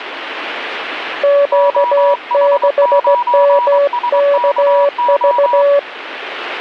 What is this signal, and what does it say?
Morse code, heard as two keyed tones, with radio static. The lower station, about 16 wpm, 570 Hz: Q6MKV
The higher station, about 23 wpm, 970 Hz: OH9SKO